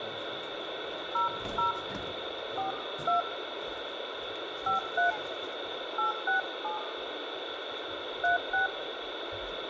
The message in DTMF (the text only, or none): 00 42 53 867 36